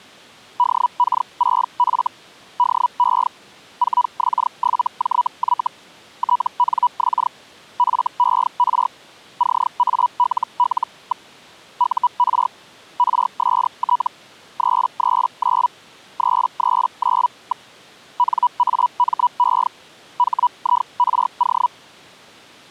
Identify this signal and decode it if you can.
Hellschreiber (Feld-Hell, 122.5 baud), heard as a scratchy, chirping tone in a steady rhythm, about 980 Hz. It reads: DK6F DE 4X7JY TNX FER CALL. UR RST 339 339. NAME HIRO